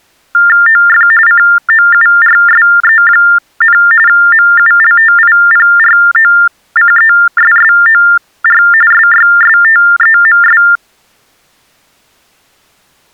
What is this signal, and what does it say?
TTY/TDD text telephone tones (45.45 baud Baudot), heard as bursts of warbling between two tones, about 400 Hz shift, 1600 Hz centre. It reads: OF COURSE, MULTIPROCESSOR SYSTEMS